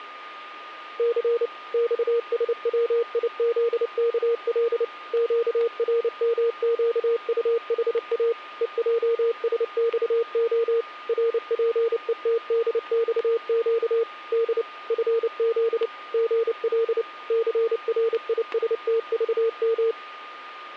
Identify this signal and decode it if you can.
Morse code, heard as a keyed tone, machine-sent, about 29 wpm, 460 Hz, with static crashes and a steady whistle near 1220 Hz. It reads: C XSWIZKL QRMQUHA EJSXO RPETDXQ D FZ GL CRISTVM